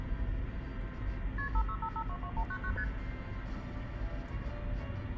Multi-frequency trunk signalling (R1, as on North American trunks), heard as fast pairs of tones, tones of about 70 ms, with phone line noise, room echo and the noise inside a car. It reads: KP 565522199 ST